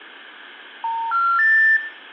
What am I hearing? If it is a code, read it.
Telephone call progress tone (North American plan), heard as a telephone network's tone, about 910, 1370, 1800 Hz, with room echo. Special information tone.